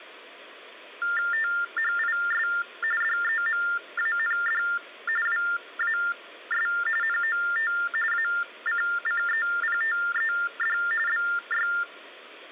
TTY/TDD text telephone tones (45.45 baud Baudot), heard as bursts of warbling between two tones, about 400 Hz shift, 1600 Hz centre. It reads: THIS DEMAND WAS NOT ACCEPTED BY